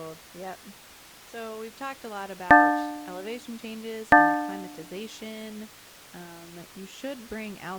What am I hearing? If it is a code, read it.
Clock strike, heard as a bell, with speech in English. 2. Two o'clock.